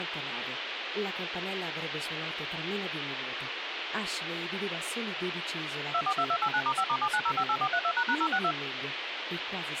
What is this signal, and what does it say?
DTMF, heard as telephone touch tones, dialled by machine, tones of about 70 ms, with phone line noise. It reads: 242289*5*79058432##062